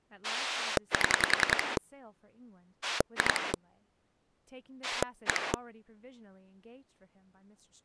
Pulse dialling, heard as a rotary dial, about 10 pulses a second, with speech in English. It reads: 7 2 1